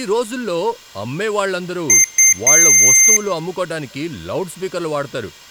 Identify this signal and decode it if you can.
Beep code, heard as beeps from a small speaker, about 2100 Hz, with room echo and speech in Telugu. 2 short, 1 long.